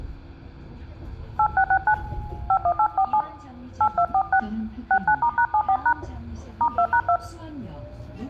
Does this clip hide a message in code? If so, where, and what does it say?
Yes: DTMF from 1.4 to 7.2 s, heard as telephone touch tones, dialled by hand, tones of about 70 ms, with the noise inside a bus. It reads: 8669 51847 8246 69*#74# *2#2